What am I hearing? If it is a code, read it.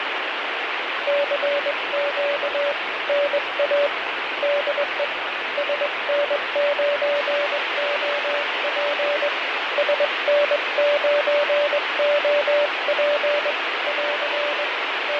Morse code, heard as a keyed tone, hand-sent with a straight key, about 21 wpm, 580 Hz, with heavy radio static and fading. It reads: CQ NA DE SN9OP SN9OP <AR> …